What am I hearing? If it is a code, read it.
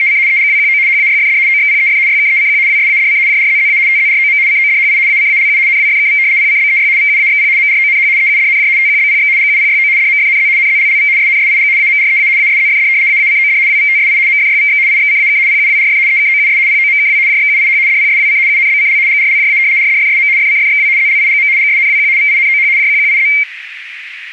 RTTY (75 baud, 170 Hz shift), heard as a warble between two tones, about 2200 Hz centre, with radio static. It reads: … EGWQO HAYFD OXPEF YKECQ WSADC JRZZA TZROM CODHI ACALU NWFKV PCBEY VUAXP MRONH EUDNJ TQBPX GUPYO DMFNZ NZLLV SNSIG AMREA ASZFD AACOD WVTSI MFYVX IXCAK PUWRF EKOUS POMKW JXUIH DPSWC UNBCL GRLJA RDFSM FCFXW ZLIGM GSNWQ VINOH JQQIZ